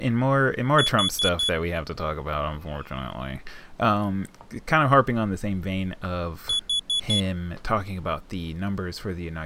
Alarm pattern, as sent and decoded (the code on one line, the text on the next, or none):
4 beeps and a pause
temporal four